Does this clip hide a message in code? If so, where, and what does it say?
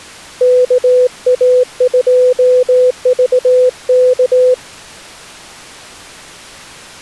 Yes: Morse code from 0.4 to 4.6 s, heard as a keyed tone, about 18 wpm, 500 Hz. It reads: KA2VK